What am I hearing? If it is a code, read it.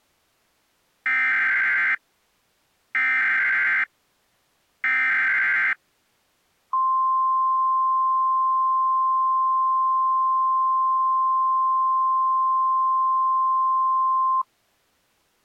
Emergency Alert System (SAME) tones (header bursts, then the 1050 Hz attention tone), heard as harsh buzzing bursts, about 520.83 baud.